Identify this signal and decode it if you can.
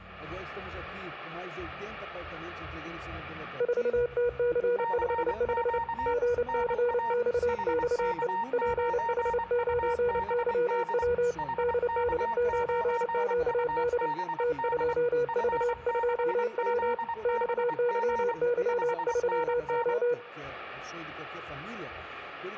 Morse code, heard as two keyed tones. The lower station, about 29 wpm, 480 Hz: 4TC55 GCXXE PH9YW DD9QD T2V2W XYY3O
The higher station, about 24 wpm, 920 Hz: CQ NA HK9UBD HK9UBD F6ZBG 5NN